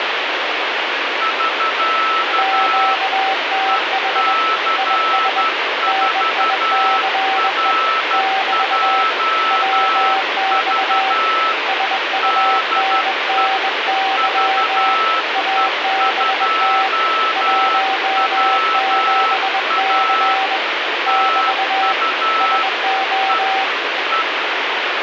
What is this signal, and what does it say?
Morse code, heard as two keyed tones, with heavy radio static. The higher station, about 12 wpm, 1310 Hz: <SK> EC4RJV DE VE2WA TU E E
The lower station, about 21 wpm, 770 Hz: QTH IS NICE <BT> WX SUNNY ABT 17C <BT> SO